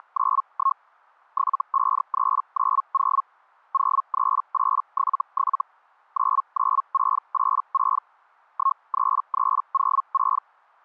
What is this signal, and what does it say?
Hellschreiber (Feld-Hell, 122.5 baud), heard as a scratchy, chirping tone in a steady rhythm, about 1080 Hz. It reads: … 75390 03877 99686 13306